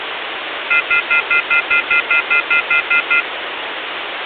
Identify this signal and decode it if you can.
Telephone call progress tone (North American plan), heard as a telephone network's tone, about 1400, 2050, 2450, 2600 Hz, 0.1 s on and 0.1 s off, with phone line noise. Off-hook warning tone.